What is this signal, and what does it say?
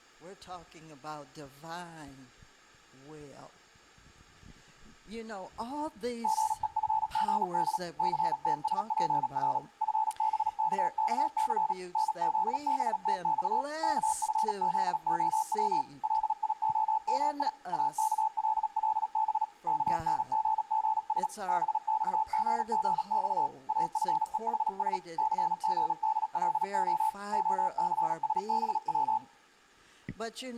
Morse code (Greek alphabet), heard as a keyed tone, machine-sent, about 37 wpm, 870 Hz, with room echo. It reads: ΓΕΦΓΔ ΘΤΣΠΡ ΦΒΚΚΘ ΝΖΒΤΞ ΚΦΖΟΩ ΛΙΟΜΙ ΑΚΛΛΒ ΚΝΓΓΣ ΒΞΓΓΞ ΑΦΕΗΣ ΘΓΔΛΟ ΟΘΣΒΩ